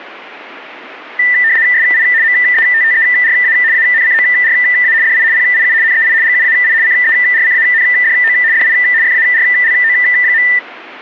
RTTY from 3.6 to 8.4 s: ANCORA DI PIU NEI GUAI CERCANDO

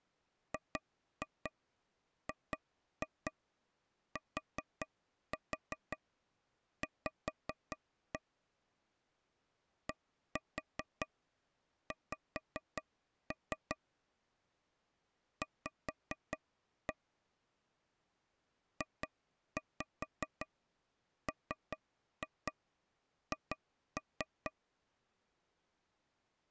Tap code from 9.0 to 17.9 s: DX V

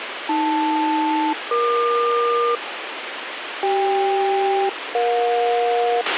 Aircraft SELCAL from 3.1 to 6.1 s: CK-EJ

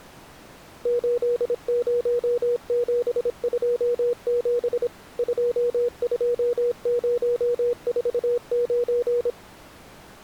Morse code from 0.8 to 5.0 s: 80727

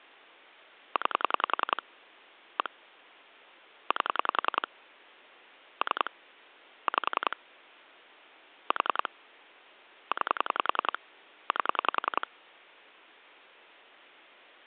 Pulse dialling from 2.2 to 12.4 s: 1 8 3 5 4 9 8

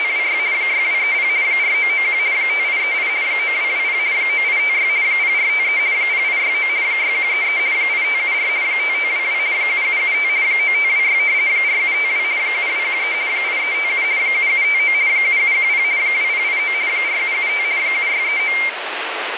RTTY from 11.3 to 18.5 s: 4752 7213 8357 7759 7710 2089 4775 7639

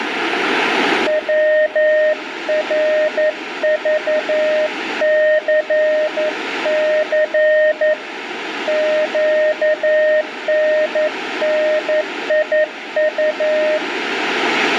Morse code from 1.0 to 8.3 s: WRVCC

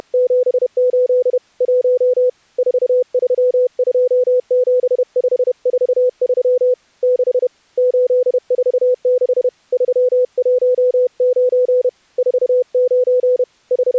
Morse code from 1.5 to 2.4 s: 1

